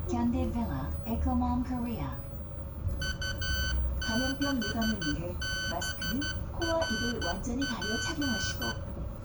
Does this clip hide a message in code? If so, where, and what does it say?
Yes: Morse code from 3.0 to 8.8 s, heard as electronic beeps, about 12 wpm, 1500 Hz, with room echo and the noise inside a bus. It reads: U6BRP